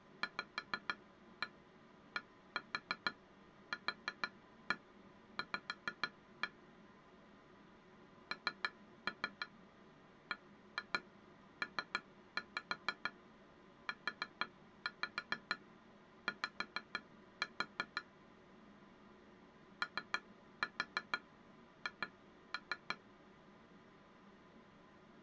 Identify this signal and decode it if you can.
Tap code, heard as taps on glass, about 6 knocks a second. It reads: VDQV NBPUY OH